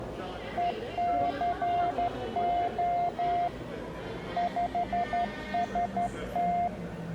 Morse code, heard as a keyed tone, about 12 wpm, 700 Hz, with the noise of a crowd indoors. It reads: ECO 5ST